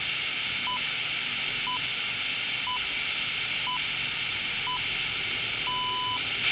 Radio time signal (six pips, as the Greenwich Time Signal), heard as pips, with radio hiss, a squelch burst at the end, room echo and the noise inside a lift.